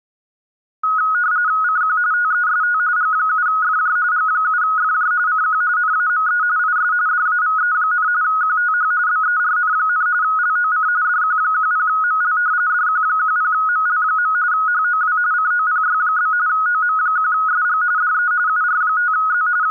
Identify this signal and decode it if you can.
RTTY (45.45 baud, 170 Hz shift), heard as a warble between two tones, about 1360 Hz centre. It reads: CQ TEST G7FJ G7FJ CQ NAME IS DAVE, QTH BERN, LOC DQ10ML DQ10ML. HOW COPY? OM1SG DE UR5Z …